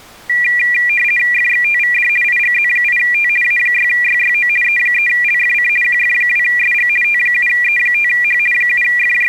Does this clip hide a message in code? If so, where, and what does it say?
Yes: RTTY (50 baud, 450 Hz shift) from 0.3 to 9.3 s, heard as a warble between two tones, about 2150 Hz centre. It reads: FXTVD IGZ8T A6YYO E3LFC QF2SG T7E5H …